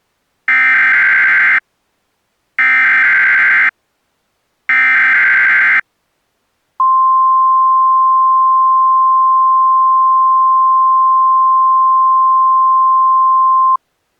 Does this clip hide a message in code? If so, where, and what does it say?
Yes: Emergency Alert System (SAME) tones (header bursts, then the 1050 Hz attention tone) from 0.5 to 13.8 s, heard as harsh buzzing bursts, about 520.83 baud.